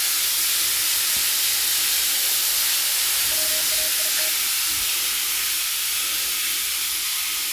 Morse code, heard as a keyed tone, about 40 wpm, 620 Hz, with the noise of a restroom. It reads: WAIT